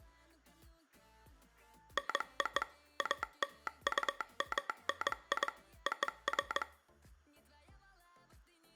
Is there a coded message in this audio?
Yes: Morse code (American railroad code) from 1.9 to 6.7 s, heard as a telegraph sounder, machine-sent. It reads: NO ALUMNI OF